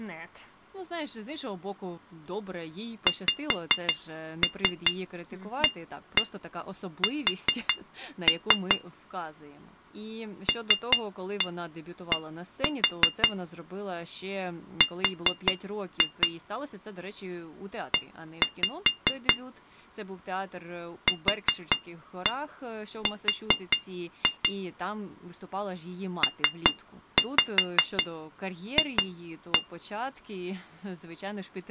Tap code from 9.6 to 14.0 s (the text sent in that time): LD